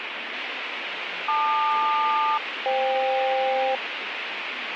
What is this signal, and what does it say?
Aircraft SELCAL, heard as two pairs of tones, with radio static and speech in Malayalam. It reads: LQ-FK